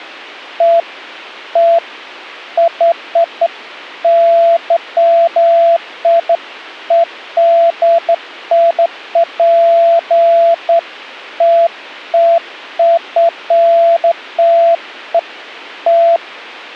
Beeps of irregular length, with a squelch burst at the end. There is no code.